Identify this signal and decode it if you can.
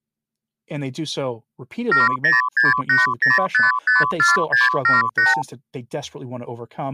Multi-frequency trunk signalling (R2, with the far end's replies), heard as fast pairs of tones, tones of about 160 ms, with speech in English. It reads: 70680554678